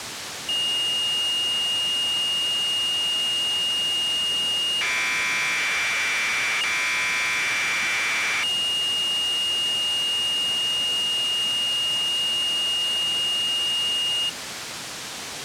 Commodore tape loading (standard loader), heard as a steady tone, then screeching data, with tape hiss.